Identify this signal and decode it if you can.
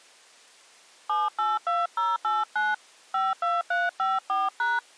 DTMF, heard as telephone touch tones, dialled by hand, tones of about 190 ms. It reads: 782089 52354#